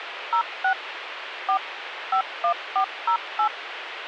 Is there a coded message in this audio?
Yes: DTMF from 0.3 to 3.5 s, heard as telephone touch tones, dialled by machine, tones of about 90 ms, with radio hiss. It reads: 06 4 51408